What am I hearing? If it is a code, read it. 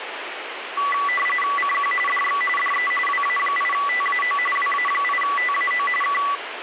RTTY (45.45 baud, 850 Hz shift), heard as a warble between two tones, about 1550 Hz centre, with radio static. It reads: CQ DX DE WA8TAO WA8TAO K